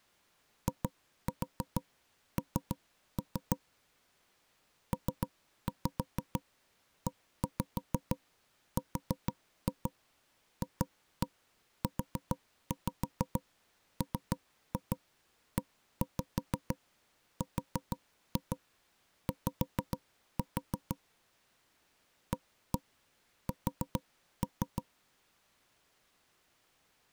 Tap code, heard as knocks on wood, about 6 knocks a second. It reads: IN PERFUMERY AS